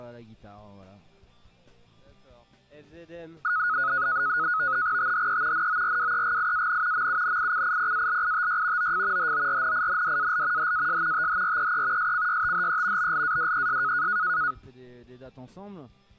NAVTEX (SITOR-B), 100 baud, 170 Hz shift, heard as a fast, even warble, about 1360 Hz centre. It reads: THE NORWEGIAN MUNICIPALITY OF HORNINDAL HAS THREE SCYTHE BLADES